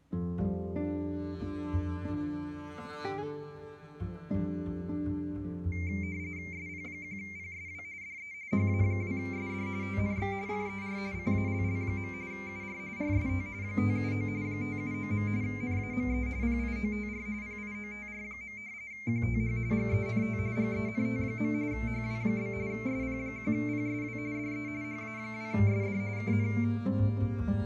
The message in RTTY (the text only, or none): SP1PSW DE HA2SD TNX FER CALL. UR RST 579 579. NAME PIOTR PIOTR. QTH GENT GENT. HW? SP1PSW DE HA2SD KN